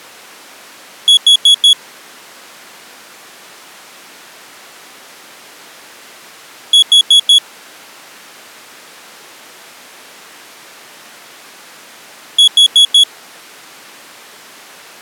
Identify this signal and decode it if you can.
Alarm pattern, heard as an alarm's beeps, played three times, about 3350 Hz. Temporal four. Carbon monoxide.